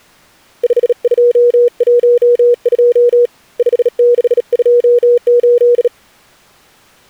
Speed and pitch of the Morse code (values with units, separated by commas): 37 wpm, 480 Hz